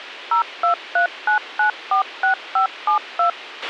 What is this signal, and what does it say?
DTMF, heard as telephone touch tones, dialled by machine, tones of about 110 ms, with a squelch burst at the end. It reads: 0239946572